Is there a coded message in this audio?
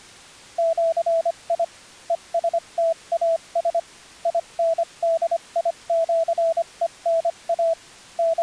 Yes: Morse code (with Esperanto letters) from 0.5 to 8.4 s, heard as a keyed tone, machine-sent, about 25 wpm, spaced as for 22 wpm, 660 Hz. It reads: ĜI ESTAS INDIĜENA …